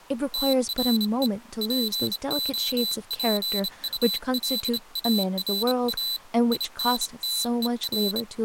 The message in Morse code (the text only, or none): TRE POPULARA INTER